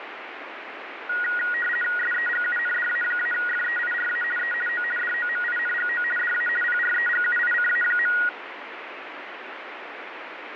RTTY (50 baud, 450 Hz shift), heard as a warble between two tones, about 1650 Hz centre, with radio static. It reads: SEGUNDA-FEIRA E O DOMINGO DA PREGUICA.